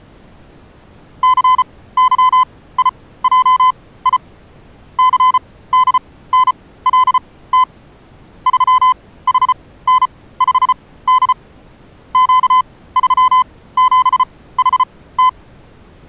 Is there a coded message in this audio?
Yes: Morse code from 1.2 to 15.4 s, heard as a keyed tone, machine-sent, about 34 wpm, spaced as for 18 wpm, 1020 Hz. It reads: CYIJI CDNLT 3HN5D Q37HT